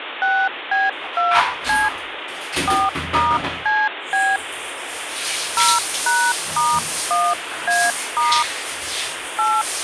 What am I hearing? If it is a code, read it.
DTMF, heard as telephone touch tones, dialled by hand, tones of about 220 ms, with phone line noise and the noise of a restroom. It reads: 6B2C 4*CB 0#*1A* 8